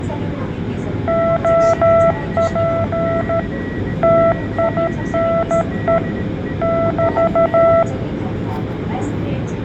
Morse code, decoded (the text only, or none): OP TINE <BT>